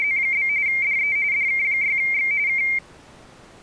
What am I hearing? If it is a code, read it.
RTTY (45.45 baud, 170 Hz shift), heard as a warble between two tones, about 2200 Hz centre. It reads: … DE DK6X K